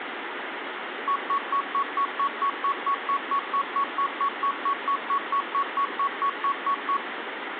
Evenly repeated beeps, with phone line noise and room echo. There is no code.